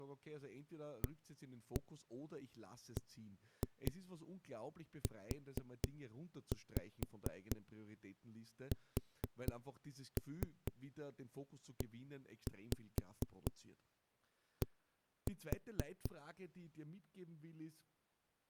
Tap code, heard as knocks on a wall, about 4 knocks a second, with speech in German. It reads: ABUSED